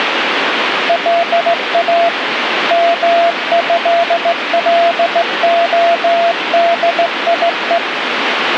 Morse code (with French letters), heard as a keyed tone, hand-sent with a straight key, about 16 wpm, 680 Hz, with radio static. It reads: LA MÉLODIE